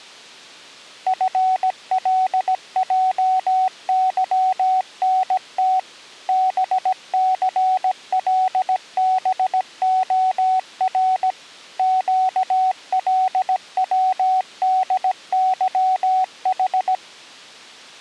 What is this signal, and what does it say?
Morse code, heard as a keyed tone, machine-sent, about 17 wpm, 750 Hz. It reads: FLJYNT BCLBOR QLWDYH